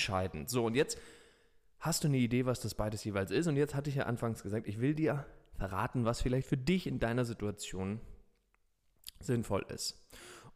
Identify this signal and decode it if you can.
Speech in German. There is no code.